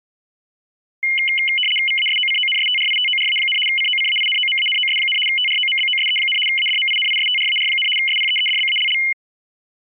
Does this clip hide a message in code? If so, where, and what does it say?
Yes: RTTY (75 baud, 850 Hz shift) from 1.0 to 9.1 s, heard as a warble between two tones, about 2550 Hz centre. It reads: VASOCONSTRITORA, COCAINOMANOS, TROMBOSE, ADMINISTRAR, SPEEDBALL